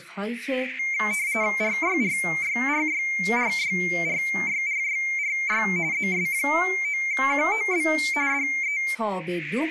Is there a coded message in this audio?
Yes: RTTY (45.45 baud, 170 Hz shift) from 0.8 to 8.9 s, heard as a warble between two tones, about 2200 Hz centre, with speech in Persian. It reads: RYRYRYRYRYRYRY ZS9QOB DE